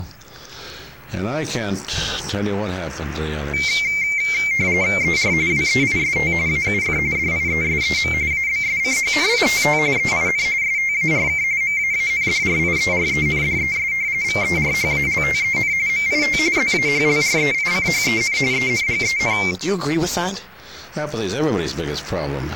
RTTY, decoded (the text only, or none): ER WEIST AUF DIESEM ABSCHNITT EIN STARK MAANDRIERENDES VERHALTEN MIT ZAHLREICHEN ENGEN